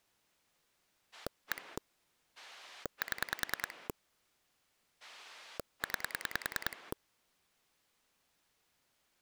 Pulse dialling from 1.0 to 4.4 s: 1 7

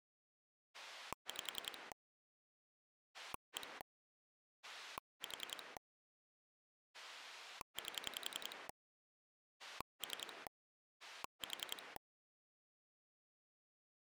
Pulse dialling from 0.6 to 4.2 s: 5 1

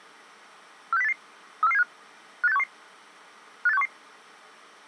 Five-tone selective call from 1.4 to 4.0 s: 34475 58611 58611

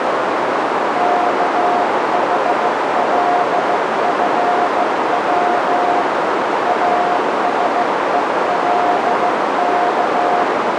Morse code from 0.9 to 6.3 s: KHLFW

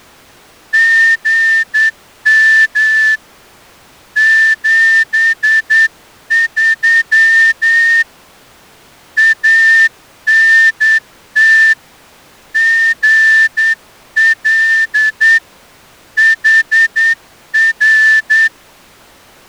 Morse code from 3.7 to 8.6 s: 73

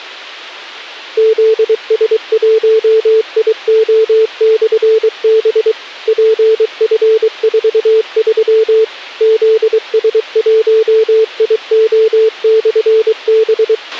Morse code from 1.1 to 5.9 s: ZS1IO/B

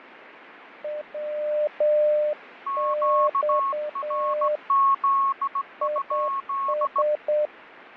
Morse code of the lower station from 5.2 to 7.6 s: IS

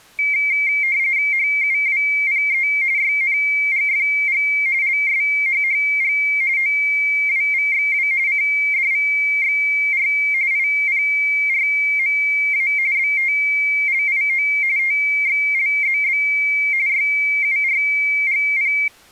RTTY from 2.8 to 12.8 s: YNGFG LSHHG OWVXW CDVXR IPRMA

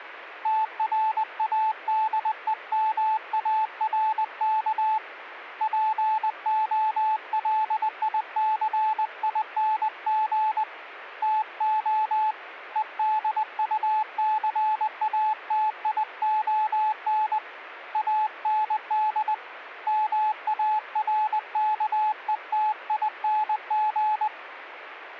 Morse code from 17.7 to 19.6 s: AND

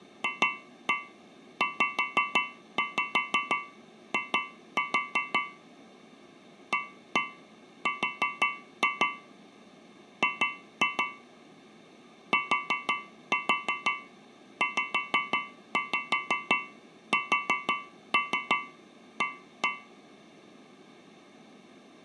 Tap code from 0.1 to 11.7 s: FZI AR G

